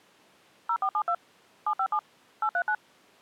DTMF, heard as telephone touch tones, dialled by machine, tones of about 70 ms. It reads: 0472 757 839